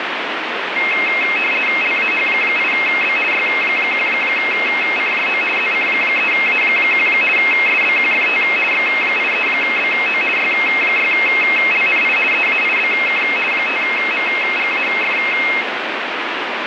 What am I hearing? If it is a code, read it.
RTTY (50 baud, 450 Hz shift), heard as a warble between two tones, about 2350 Hz centre, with radio static. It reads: LAH8B Y1CJO ZC3A1 SBQFT X83BO Y6LNI EAIBK 5MGAF